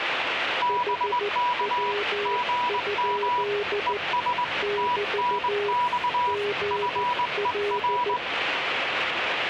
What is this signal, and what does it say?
Morse code, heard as two keyed tones, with radio static and the noise inside a subway train. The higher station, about 20 wpm, 980 Hz: BK GM ES TNX FER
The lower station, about 14 wpm, 410 Hz: HW? <BT> GL